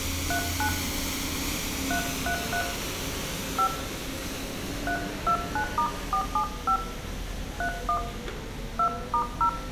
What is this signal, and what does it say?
DTMF, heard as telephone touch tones, dialled by hand, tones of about 90 ms, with room echo and street noise. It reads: 39 333 5 329*475 31 2*0